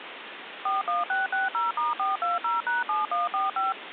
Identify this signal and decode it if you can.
DTMF, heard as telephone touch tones, dialled by machine, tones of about 160 ms, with phone line noise. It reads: 41660*420#7145